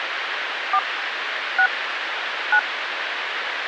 DTMF, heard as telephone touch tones, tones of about 70 ms, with phone line noise. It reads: 4 6 9